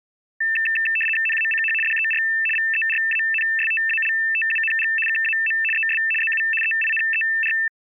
RTTY (75 baud, 850 Hz shift), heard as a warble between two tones, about 2200 Hz centre. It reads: NACH DER VERANSTALTUNG KAM ES ZU EINER